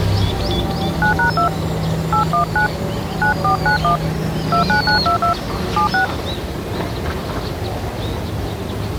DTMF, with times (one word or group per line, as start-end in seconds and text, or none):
1.0-1.5 9#2
2.1-2.7 819
3.2-4.0 9491
4.5-5.3 29922
5.8-6.0 76